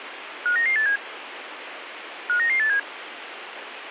Five-tone selective call (CCIR), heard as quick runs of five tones, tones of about 100 ms, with radio hiss. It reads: 59987 59987